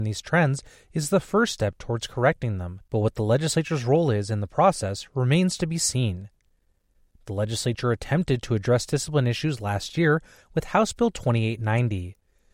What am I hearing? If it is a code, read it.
Speech in English. There is no code.